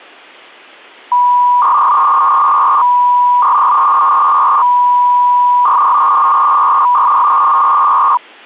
300-baud modem data (V.21 tones), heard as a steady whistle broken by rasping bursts, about 300 baud, 200 Hz shift.